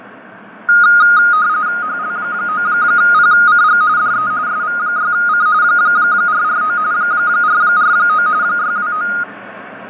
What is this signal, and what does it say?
RTTY (45.45 baud, 170 Hz shift), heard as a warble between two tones, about 1340 Hz centre, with fading and street noise. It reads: HL9PCG DE SV6C 449 449 629